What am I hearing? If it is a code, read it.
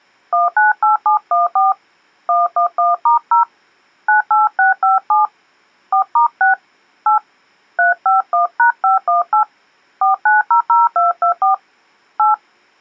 DTMF, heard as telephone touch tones, dialled by hand, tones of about 140 ms. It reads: 198714 111*0 98657 4*6 8 351#518 4900224 8